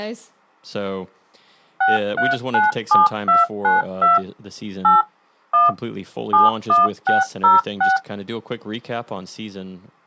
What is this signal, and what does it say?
DTMF, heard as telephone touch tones, dialled by machine, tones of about 160 ms, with speech in English. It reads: 6397292 8 1 71606